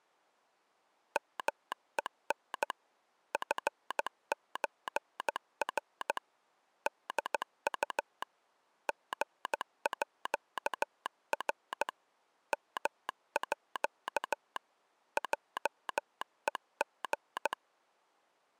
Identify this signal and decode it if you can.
Morse code (with Danish letters), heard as a telegraph sounder, hand-sent with a paddle, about 15 wpm. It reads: MEN FØR DU GÅR MÅ JEG